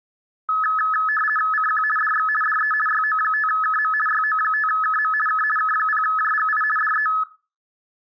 RTTY (50 baud, 450 Hz shift), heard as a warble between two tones, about 1500 Hz centre. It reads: CQ DX DE YO5KM YO5KM K K0JGI DE